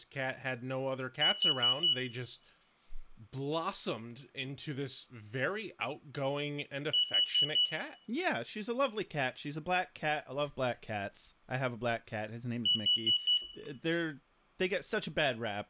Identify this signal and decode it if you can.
Alarm pattern, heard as an alarm's beeps, played three times, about 2950 Hz, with room echo and speech in English. Temporal four. Carbon monoxide.